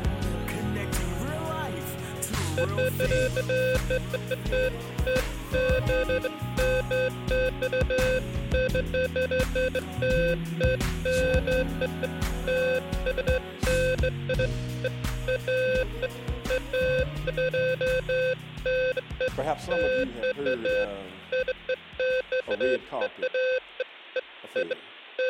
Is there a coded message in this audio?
No, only beeps of irregular length.